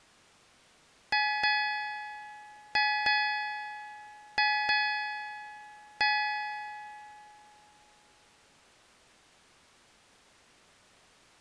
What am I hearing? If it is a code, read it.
Ship's bell, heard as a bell. 7. Seven half-hours of the watch have passed.